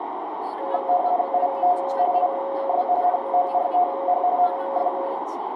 RTTY (50 baud, 170 Hz shift), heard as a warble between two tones, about 630 Hz centre, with radio static, a narrow filter and speech in Odia. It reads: IT IS NORTH OF